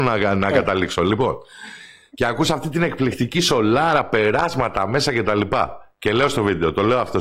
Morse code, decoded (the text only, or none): none